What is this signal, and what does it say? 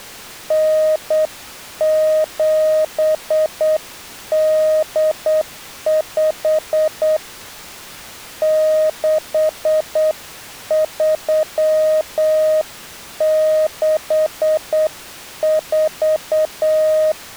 Morse code (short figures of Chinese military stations), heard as a keyed tone, hand-sent with a straight key, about 8 wpm, 620 Hz. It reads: 9785 6364